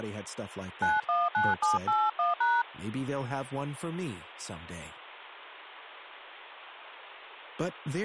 DTMF, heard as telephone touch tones, dialled by hand, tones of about 200 ms, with speech in English. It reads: 919781#